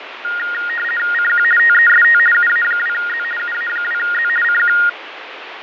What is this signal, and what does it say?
RTTY (50 baud, 450 Hz shift), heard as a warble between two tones, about 1650 Hz centre, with radio static and fading. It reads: CQ TEST UA2Z UA2Z CQ